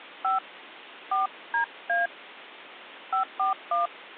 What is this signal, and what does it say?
DTMF, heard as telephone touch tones, dialled by hand, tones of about 110 ms. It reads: 5 4DA 541